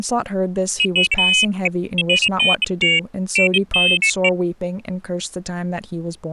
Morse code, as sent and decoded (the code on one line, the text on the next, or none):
none